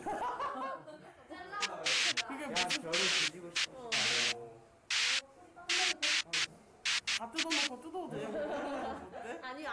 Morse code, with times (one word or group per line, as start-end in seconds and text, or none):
none